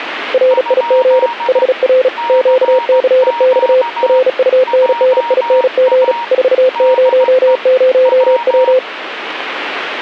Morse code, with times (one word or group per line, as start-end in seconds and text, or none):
0.3-1.3 RIG
1.5-2.1 HR
2.3-3.8 QCX
4.0-6.1 RUNNING
6.3-8.8 400W